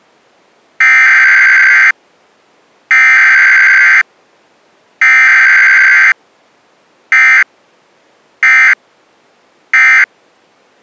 Emergency Alert System (SAME) tones (header bursts, then end-of-message bursts), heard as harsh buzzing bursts, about 520.83 baud.